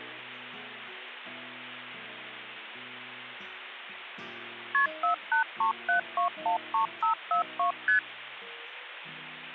Multi-frequency trunk signalling (R1, as on North American trunks), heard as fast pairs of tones, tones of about 110 ms, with phone line noise. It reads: KP 4837213542 ST